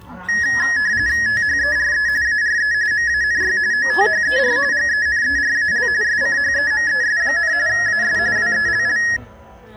RTTY (45.45 baud, 170 Hz shift), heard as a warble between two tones, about 1800 Hz centre, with the noise of a park. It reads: THERE ARE MANY OTHER GENERAL SCHEMES, AS WELL